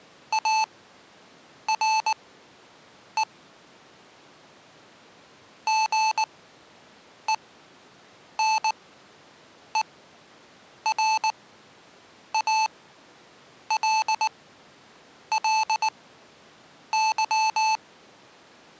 Morse code, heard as electronic beeps, machine-sent, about 19 wpm, spaced as for 7 wpm, 880 Hz. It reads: ARE GENERALLY